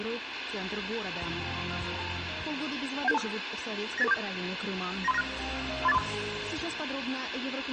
Five-tone selective call (EIA), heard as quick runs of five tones, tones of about 30 ms, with radio hiss. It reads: 17725 98847 93596 38435